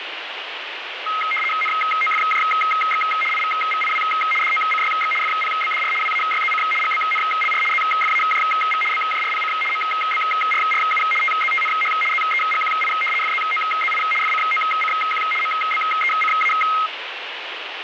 RTTY (75 baud, 850 Hz shift), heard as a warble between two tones, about 1700 Hz centre, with radio static. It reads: NOFJX IVVIW DOCYX FPBDR WAYZC GBNLR ZFAJV BJRPC MBRRU TZTNH ZEGQI FZOZI FCOCQ MBECA